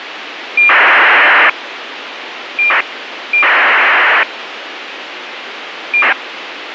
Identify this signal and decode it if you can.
ACARS aircraft data, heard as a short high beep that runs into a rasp, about 2400 baud, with radio hiss.